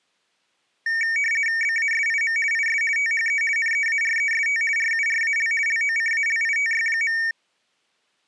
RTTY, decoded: BASIM IS THE NEAREST RURAL LOCALITY.

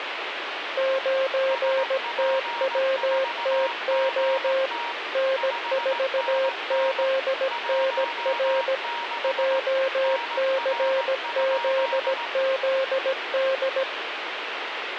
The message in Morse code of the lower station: 9TWTO N4ZNR JCZZD

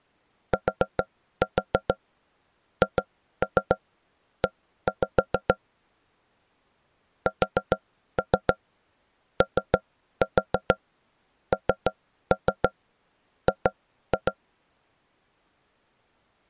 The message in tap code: THE SONG

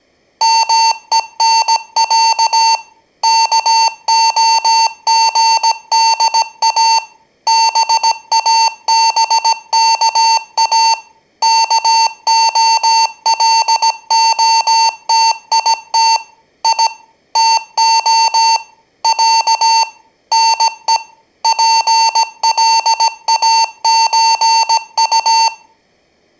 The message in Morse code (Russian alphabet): МЕНЯ КОГДА БАБКА КОЛОТИТ И ТО Я НЕ ПЛАЧУ

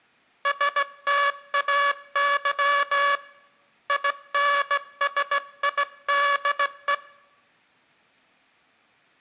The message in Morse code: STAY INSIDE

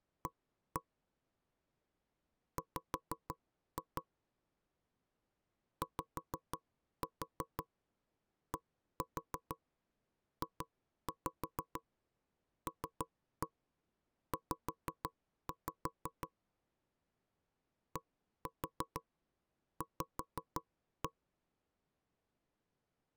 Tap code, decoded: A W YDJLZ DV

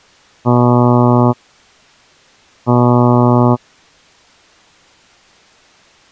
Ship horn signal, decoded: 2 short

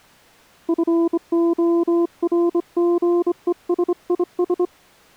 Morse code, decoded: FORGESIS

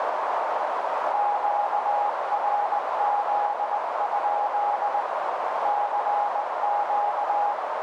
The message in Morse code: QRZ? CQ

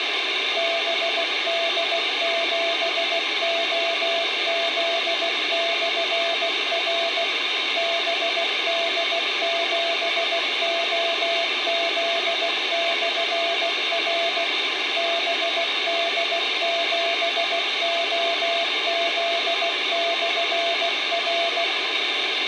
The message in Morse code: BD7OZ/R BD7OZ/R BD7OZ/R

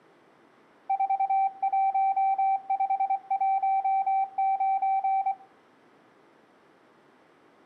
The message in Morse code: 41519

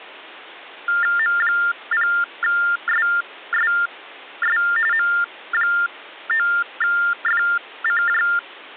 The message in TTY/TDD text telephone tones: M0SSS M9FCJ

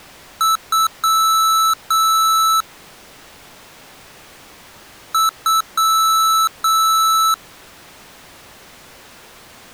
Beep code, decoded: 2 short, 2 long

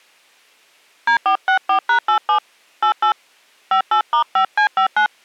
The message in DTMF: D464#87 88 58*5C59

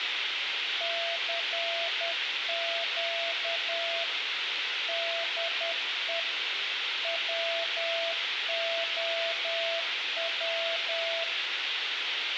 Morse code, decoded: CQ DE WOW

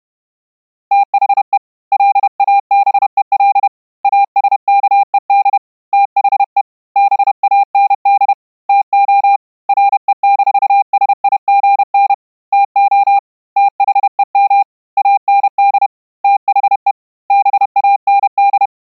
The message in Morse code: THE LABEL ASKED THE BAND TO RE-SIGN TO THEM AND THE BAND

